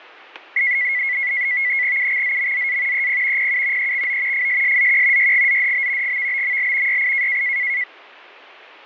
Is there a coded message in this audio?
Yes: NAVTEX (SITOR-B), 100 baud, 170 Hz shift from 0.6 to 7.8 s, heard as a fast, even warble, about 2050 Hz centre, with static crashes. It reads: UXZMZA EP PU EXO FSSZQ YGZDB GVBML YI